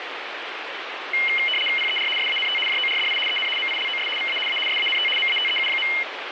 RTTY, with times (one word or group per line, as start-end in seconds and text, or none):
1.8-2.1 PER
2.2-2.6 SANT
2.7-3.2 JORDI
3.3-3.5 EN
3.6-4.1 MILOS
4.2-4.4 VA
4.5-4.6 A
4.7-5.1 SANT
5.2-5.9 MATEU.